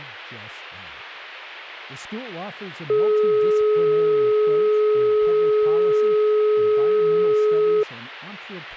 Telephone call progress tone (425 Hz plan, as in most of Europe), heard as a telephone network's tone, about 420 Hz, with speech in English. Dial tone.